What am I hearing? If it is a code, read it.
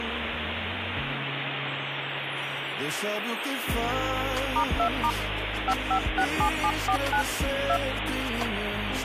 DTMF, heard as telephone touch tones, dialled by hand, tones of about 80 ms, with phone line noise. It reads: *2* 5567749 2